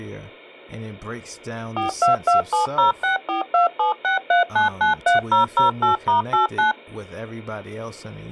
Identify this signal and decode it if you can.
DTMF, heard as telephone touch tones, dialled by machine, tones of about 130 ms, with speech in English. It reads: 42270642763993008*89